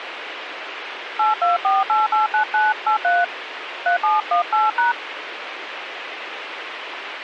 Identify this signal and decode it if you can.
DTMF, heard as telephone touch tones, dialled by hand, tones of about 140 ms, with radio hiss. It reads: 824889983 3718#